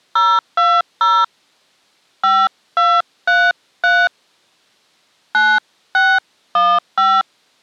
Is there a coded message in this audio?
Yes: DTMF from 0.2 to 7.2 s, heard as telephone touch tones, dialled by hand, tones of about 240 ms. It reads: 020 5233 9615